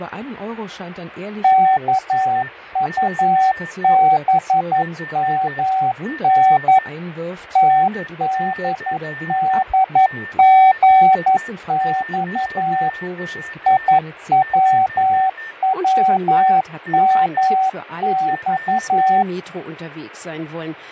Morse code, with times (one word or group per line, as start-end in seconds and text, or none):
1.4-6.8 KUBMN
7.6-12.9 TDDGX
13.7-19.2 IWWMX